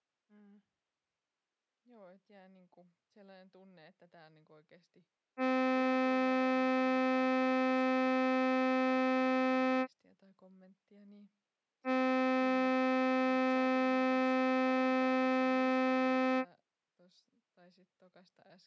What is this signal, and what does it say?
Ship horn signal, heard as a ship's horn, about 260 Hz, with speech in Finnish. 2 long. At sea: a vessel under power that has stopped in fog.